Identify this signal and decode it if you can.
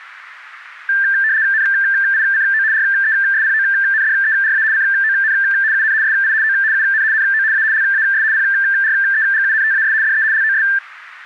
RTTY (75 baud, 170 Hz shift), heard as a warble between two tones, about 1700 Hz centre, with static crashes. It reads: NICO RESPONDERA CON UN SI O UN NO A LAS PREGUNTAS DE LOS